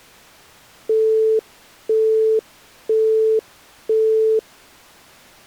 Telephone call progress tone (single-tone plan, as in Europe, Japan and elsewhere), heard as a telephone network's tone, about 440 Hz, 0.5 s on and 0.5 s off. Busy tone.